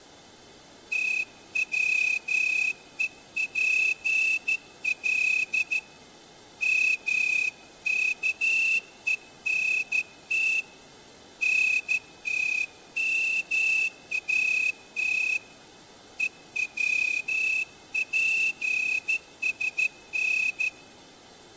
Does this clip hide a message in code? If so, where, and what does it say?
Yes: Morse code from 0.9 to 20.7 s, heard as a whistle, hand-sent with a straight key, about 13 wpm, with room echo. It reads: TWEPL MKENT NTMAT EWPSN